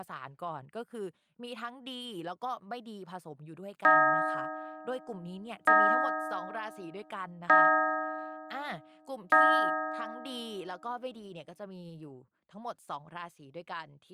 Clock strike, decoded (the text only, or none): 4